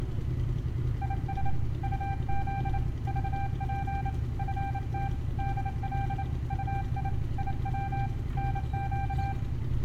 Morse code, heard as a keyed tone, hand-sent with a paddle, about 28 wpm, 790 Hz, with room echo and street noise. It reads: IS UZ VP FT DL UI IW NQ